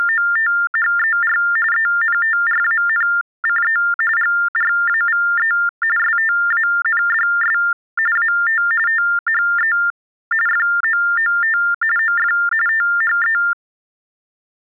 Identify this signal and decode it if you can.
TTY/TDD text telephone tones (45.45 baud Baudot), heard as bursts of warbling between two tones, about 400 Hz shift, 1600 Hz centre. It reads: … ENTRANCE GRAVE STANDS AT THE FOOT OF THE